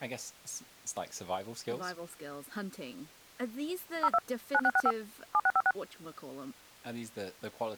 DTMF, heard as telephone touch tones, dialled by machine, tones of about 50 ms, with speech in English. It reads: 02 9665 7656